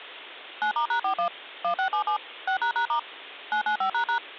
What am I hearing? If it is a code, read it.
DTMF, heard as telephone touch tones, dialled by machine, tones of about 100 ms. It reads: 9*#41 1677 6##* 995##